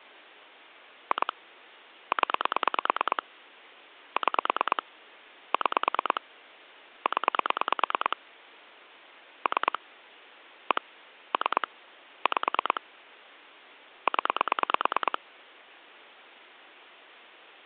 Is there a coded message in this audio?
Yes: pulse dialling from 1.1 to 15.2 s, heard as clicks on a phone line, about 9 pulses a second. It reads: 2 0 6 6 0 3 1 3 5 0